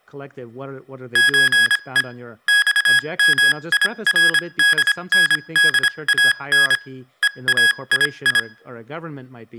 Morse code (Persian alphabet), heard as electronic beeps, machine-sent, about 26 wpm, spaced as for 22 wpm, 1650 Hz, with speech in English. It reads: چه خمیردندان هایی